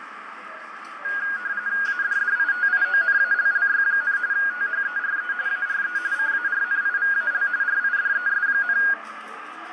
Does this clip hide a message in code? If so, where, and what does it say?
Yes: RTTY (45.45 baud, 170 Hz shift) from 1.0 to 8.9 s, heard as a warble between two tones, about 1550 Hz centre, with radio static, fading, a narrow filter and the noise of a cafe. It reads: ADDITIONALLY, THERE ARE CARNIVAL RIDES,